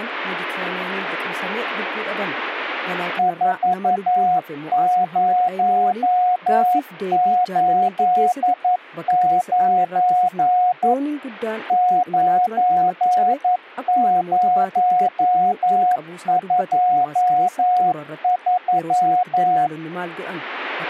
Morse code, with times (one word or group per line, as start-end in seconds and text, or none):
3.2-10.9 4089
11.7-19.7 9023